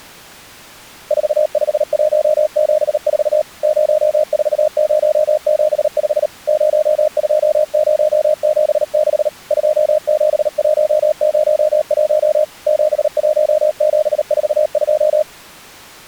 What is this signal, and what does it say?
Morse code, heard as a keyed tone, machine-sent, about 38 wpm, 610 Hz. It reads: 45174 04075 02076 27101 71742